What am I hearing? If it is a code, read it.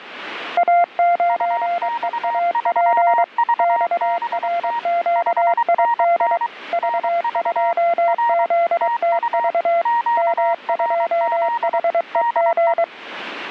Morse code, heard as two keyed tones, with radio static. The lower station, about 23 wpm, 690 Hz: A9EAP XRQID V2ZTV M2HEG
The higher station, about 23 wpm, 940 Hz: UX3VBT 5NN NV R TU QRZ DE